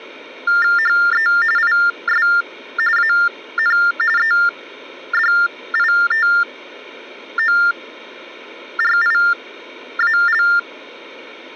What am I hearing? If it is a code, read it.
TTY/TDD text telephone tones (45.45 baud Baudot), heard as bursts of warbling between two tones, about 400 Hz shift, 1600 Hz centre. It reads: HE IS AN EDITORIAL